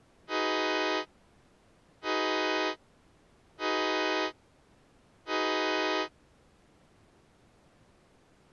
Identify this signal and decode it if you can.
Train horn signal, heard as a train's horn. 4 short. On North American railways: a request for a signal to be given or repeated.